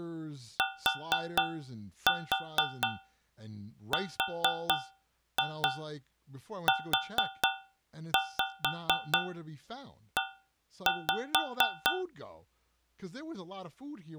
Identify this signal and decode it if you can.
Tap code, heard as taps on a metal pipe, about 4 knocks a second, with speech in English. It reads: TRUE